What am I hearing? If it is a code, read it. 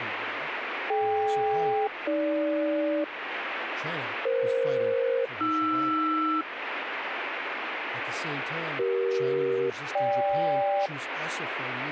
Aircraft SELCAL, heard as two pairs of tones, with radio static and speech in English. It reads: DK-AG EF-AR CE-GK